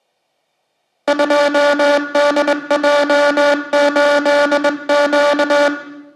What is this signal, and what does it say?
Morse code, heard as a buzzer, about 21 wpm, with room echo. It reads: 2DJ8Q